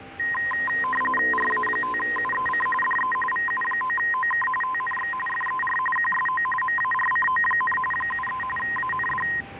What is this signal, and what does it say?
RTTY (45.45 baud, 850 Hz shift), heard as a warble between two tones, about 1450 Hz centre, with radio static, a steady whistle near 790 Hz and street noise. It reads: RA5UEC DE VU9OK TNX FER QSO MARCO, 73 AND